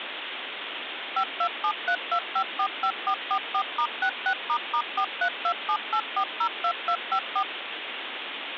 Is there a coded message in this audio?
Yes: DTMF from 1.2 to 7.4 s, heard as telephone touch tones, dialled by machine, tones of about 80 ms, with phone line noise. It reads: 52732545444*66**43278402254